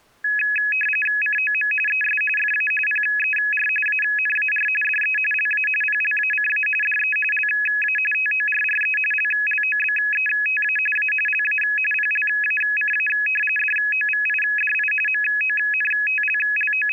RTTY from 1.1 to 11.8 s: COM ES FA PER ANAR DE LA PLACA DE LA TORRE LLOBETA A LA

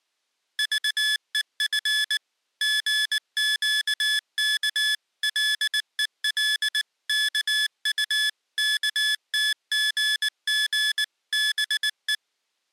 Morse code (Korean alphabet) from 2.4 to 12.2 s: 생각이었다

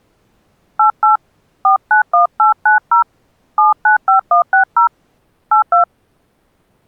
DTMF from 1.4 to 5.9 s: 491890 795160 82

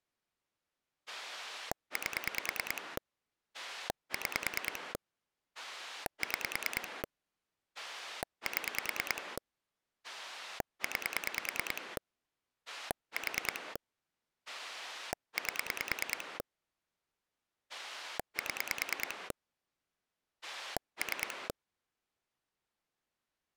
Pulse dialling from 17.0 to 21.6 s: 7 3

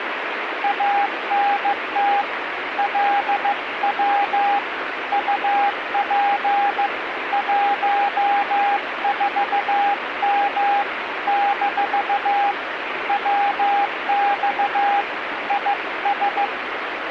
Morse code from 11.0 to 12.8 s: -

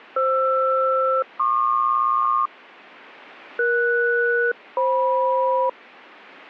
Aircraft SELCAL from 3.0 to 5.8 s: ES-FM

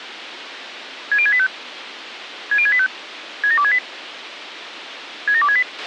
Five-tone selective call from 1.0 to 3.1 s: 60685 60685

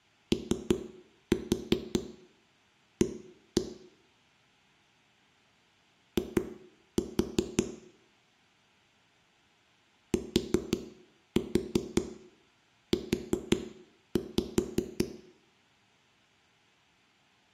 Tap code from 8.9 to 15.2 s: TU

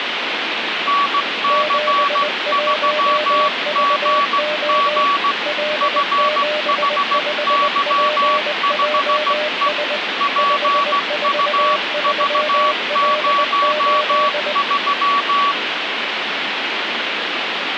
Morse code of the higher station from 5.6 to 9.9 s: FHY5E

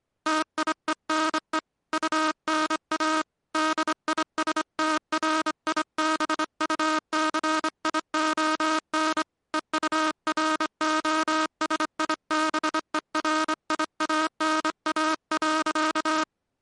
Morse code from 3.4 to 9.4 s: DISTRIBUCION

